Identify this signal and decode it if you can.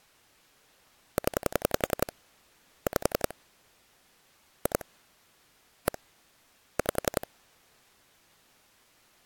Pulse dialling, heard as clicks on a phone line, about 11 pulses a second. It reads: 0 5 2 1 5